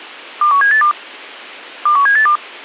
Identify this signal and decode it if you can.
Five-tone selective call (CCIR), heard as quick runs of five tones, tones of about 100 ms. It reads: 21782 21782